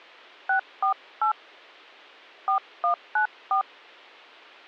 DTMF, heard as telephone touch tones, dialled by hand, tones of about 100 ms. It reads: 648 4194